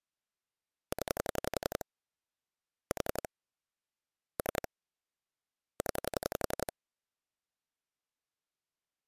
Pulse dialling, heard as clicks on a phone line, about 11 pulses a second. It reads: 0 4 3 0